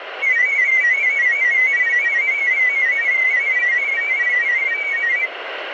Multi-tone FSK (Olivia or MFSK type), about 500 Hz wide, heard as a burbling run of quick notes, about 31.25 baud, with radio static.